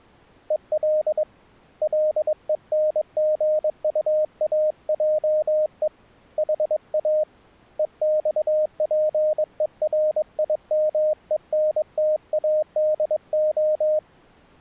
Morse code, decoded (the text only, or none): EL LENGUAJE HA EXPERIMENTADO